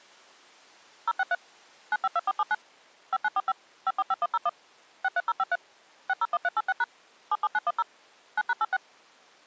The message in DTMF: 063 952479 5945 545101 63053 601386# 77910 9#86

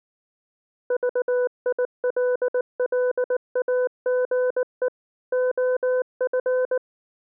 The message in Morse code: VILLAGE OF

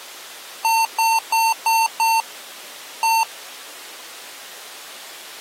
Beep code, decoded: 5-1

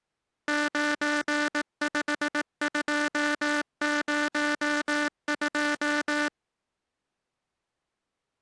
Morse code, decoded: 95202

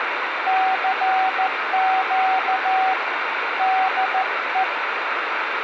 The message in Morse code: CQ DE

